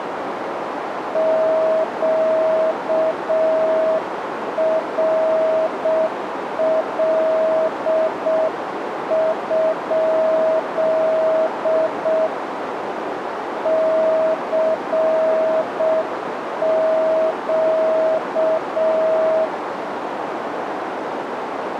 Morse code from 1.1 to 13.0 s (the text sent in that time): QRL?